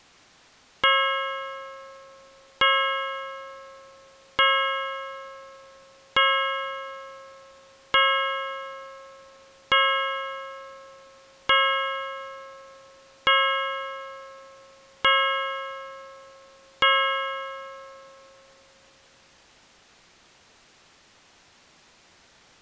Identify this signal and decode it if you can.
Clock strike, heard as a bell. 10. Ten o'clock.